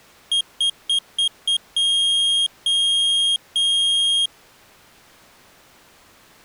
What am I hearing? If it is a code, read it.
Beep code, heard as a piezo beeper, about 3250 Hz. 5 short, 3 long.